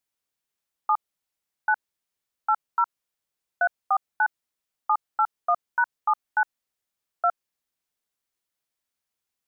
DTMF, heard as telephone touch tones, dialled by machine, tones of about 60 ms. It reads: 7 9 80 349 781#79 2